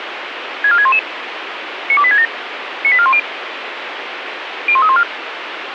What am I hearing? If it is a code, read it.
Five-tone selective call (ZVEI), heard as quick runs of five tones, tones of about 70 ms, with radio hiss. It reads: 64611 92867 98410 01314